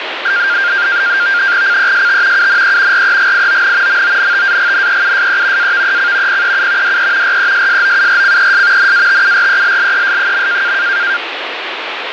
NAVTEX (SITOR-B), 100 baud, 170 Hz shift, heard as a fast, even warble, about 1500 Hz centre, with radio static. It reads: CEST UNE REGION MONTAGNEUSE AVEC PEU DE RESSOURCES NATURELLES.